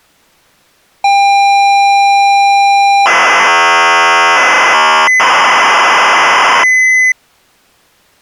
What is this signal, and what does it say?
ZX Spectrum tape loading, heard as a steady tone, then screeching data.